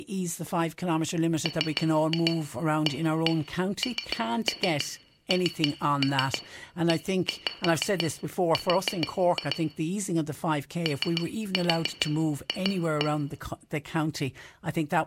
Tap code, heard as taps on glass, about 6 knocks a second, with room echo and speech in English. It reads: MANNER OF